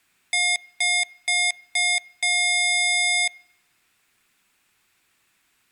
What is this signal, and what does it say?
Beep code, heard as beeps from a small speaker, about 710 Hz, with room echo. 4 short, 1 long.